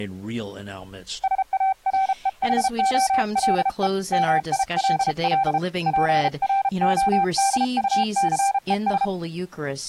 Morse code, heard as a keyed tone, hand-sent with a paddle, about 33 wpm, 780 Hz, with speech in English. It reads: SAREHOLE MILL PRODUCES